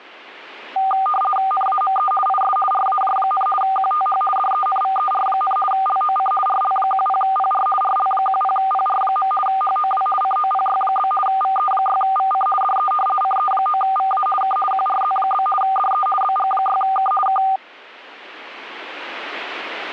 RTTY (50 baud, 450 Hz shift), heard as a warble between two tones, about 990 Hz centre. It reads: NAME IS RAJ, QTH DENVER, LOC RL10PR RL10PR. HOW COPY? VE6VC DE CE9VA K QRZ? DE BG6K K